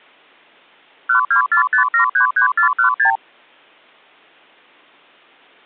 Multi-frequency trunk signalling (R2, with the far end's replies), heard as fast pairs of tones, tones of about 110 ms. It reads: 1245733416